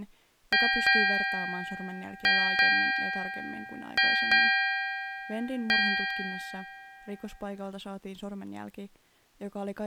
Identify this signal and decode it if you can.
Ship's bell, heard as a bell, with speech in Finnish. 7. Seven half-hours of the watch have passed.